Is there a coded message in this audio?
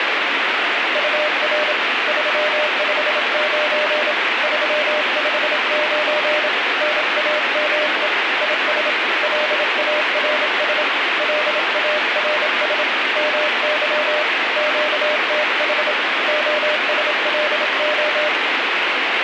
Yes: Morse code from 0.9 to 18.3 s, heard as a keyed tone, hand-sent with a bug key, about 27 wpm, 600 Hz, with heavy radio static. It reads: UR 359 359 NAME IS LARS LARS MY QTH OSLO